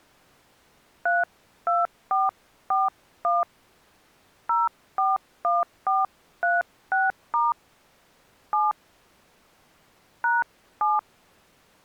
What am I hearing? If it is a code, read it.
DTMF, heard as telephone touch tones, dialled by hand, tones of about 180 ms. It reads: 32441 041436* 7 #7